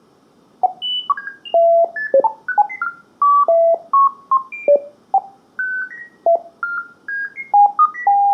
Electronic bleeps of random pitch and length, with room echo. There is no code.